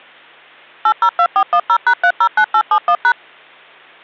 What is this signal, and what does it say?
DTMF, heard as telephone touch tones, dialled by machine, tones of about 70 ms. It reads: 802410#309871#